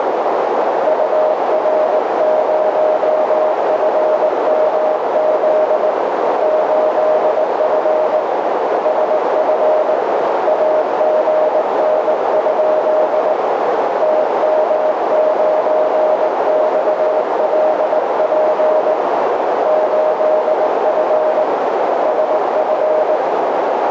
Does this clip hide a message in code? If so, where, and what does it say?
Yes: Morse code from 0.8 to 23.2 s, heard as a keyed tone, hand-sent with a paddle, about 19 wpm, 620 Hz, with heavy radio static and a narrow filter. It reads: UR0FMZ 8F SF AGN? TM9XLP 8F SF